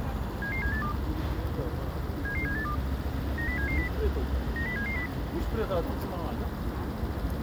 Five-tone selective call (CCIR), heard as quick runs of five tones, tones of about 100 ms, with the noise of a residential street. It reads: 77782 77782 90770 90770